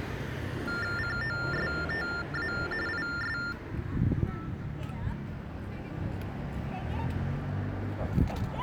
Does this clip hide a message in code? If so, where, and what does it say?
Yes: TTY/TDD text telephone tones (45.45 baud Baudot) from 0.7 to 3.5 s, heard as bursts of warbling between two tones, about 400 Hz shift, 1600 Hz centre, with street noise. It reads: COSTA IS